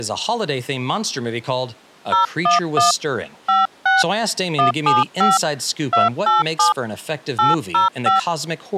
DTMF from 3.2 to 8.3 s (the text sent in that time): 56 175 287 805